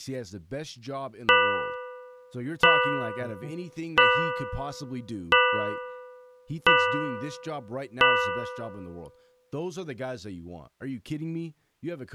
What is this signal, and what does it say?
Clock strike, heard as a bell, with speech in English. 6. Six o'clock.